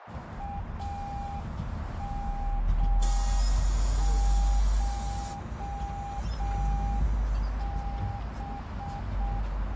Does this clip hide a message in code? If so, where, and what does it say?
Yes: Morse code (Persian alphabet) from 0.3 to 9.5 s, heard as a keyed tone, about 6 wpm, 800 Hz, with heavy radio static, a narrow filter and the noise inside a bus. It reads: امشب